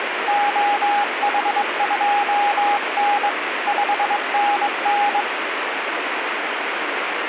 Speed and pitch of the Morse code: 22 wpm, 820 Hz

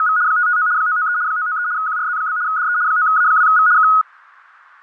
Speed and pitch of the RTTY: 75 baud, 170 Hz shift, 1360 Hz centre

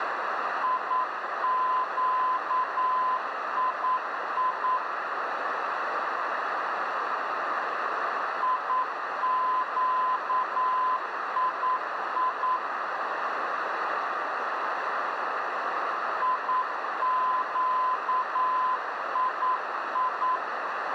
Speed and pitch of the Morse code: 9 wpm, 1020 Hz

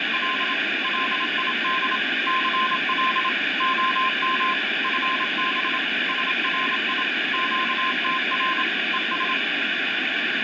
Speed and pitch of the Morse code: 27 wpm, 1040 Hz

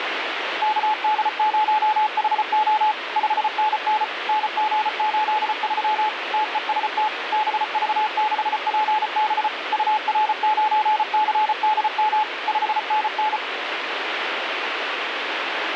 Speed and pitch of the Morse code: 34 wpm, 860 Hz

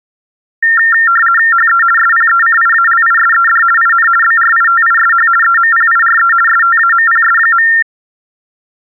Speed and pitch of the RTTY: 50 baud, 450 Hz shift, 1600 Hz centre

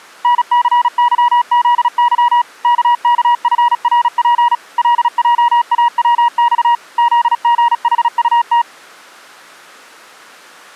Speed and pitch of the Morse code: 36 wpm, 960 Hz

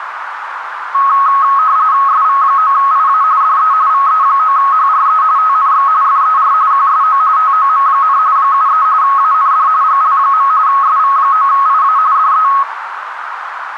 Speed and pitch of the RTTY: 45.45 baud, 170 Hz shift, 1190 Hz centre

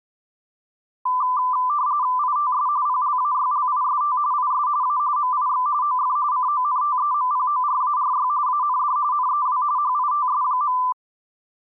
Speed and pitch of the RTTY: 45.45 baud, 170 Hz shift, 1090 Hz centre

